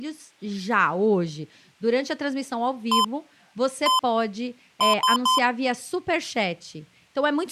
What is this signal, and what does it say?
Beep code, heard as beeps from a small speaker, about 1030 Hz, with speech in Portuguese. 1-1-3. In Phoenix BIOS tables: CMOS read or write failure.